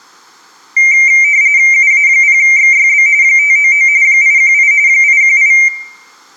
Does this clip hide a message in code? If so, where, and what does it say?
Yes: RTTY (45.45 baud, 170 Hz shift) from 0.8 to 5.7 s, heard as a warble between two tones, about 2200 Hz centre, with room echo. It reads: UA0XYB 599 818 818